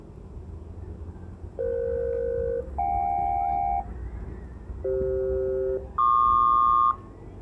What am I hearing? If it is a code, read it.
Aircraft SELCAL, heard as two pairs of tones, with the noise of a residential street. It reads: EF-JK CF-PQ